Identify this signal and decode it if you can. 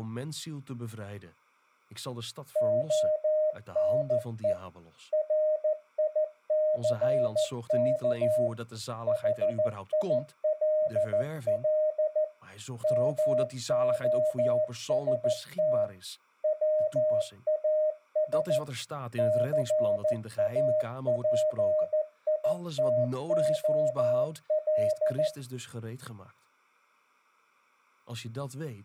Morse code, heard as a keyed tone, machine-sent, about 14 wpm, 620 Hz, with speech in Dutch. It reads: ONE RICK HILL MOST WAS CAPITOL